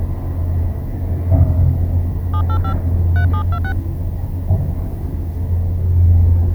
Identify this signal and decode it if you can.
DTMF, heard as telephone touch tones, dialled by hand, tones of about 80 ms, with the noise inside a lift. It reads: 785 3726